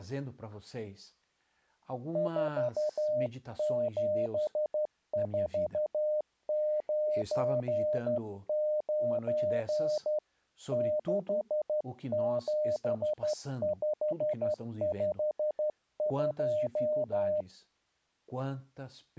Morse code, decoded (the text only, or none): 47499 67552